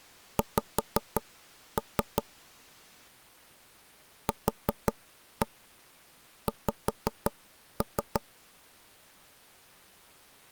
Tap code, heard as taps on a table, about 5 knocks a second. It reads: X QX